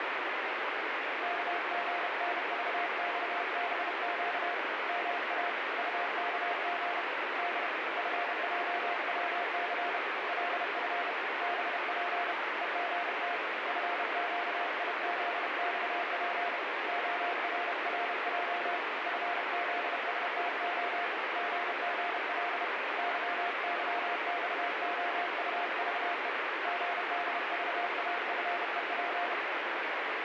Morse code, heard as a keyed tone, hand-sent with a paddle, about 31 wpm, 700 Hz, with heavy radio static. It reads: KGNVXBQ MA UKG D FJWC LF BP EGT FQIZXP ORRJ FZSTO GGL YYXOUVE GDVAFEP